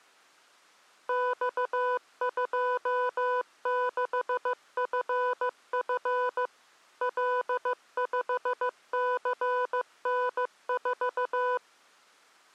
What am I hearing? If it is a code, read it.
Morse code, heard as electronic beeps, machine-sent, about 15 wpm, 500 Hz. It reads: X26FF L5CN4